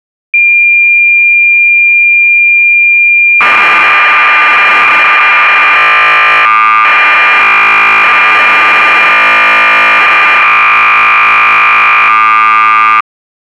Cassette data (Kansas City type), 1200 baud, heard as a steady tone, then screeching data.